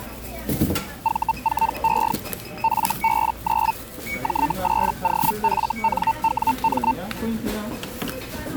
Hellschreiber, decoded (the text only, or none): V4E FB9 J8OFNWM